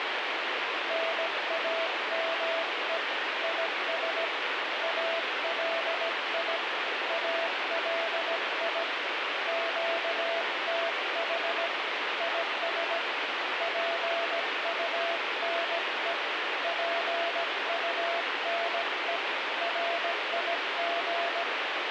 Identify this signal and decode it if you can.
Morse code, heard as a keyed tone, hand-sent with a paddle, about 17 wpm, 670 Hz, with heavy radio static. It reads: NAME IS ALI ALI QTH IS PUNE PUNE RIG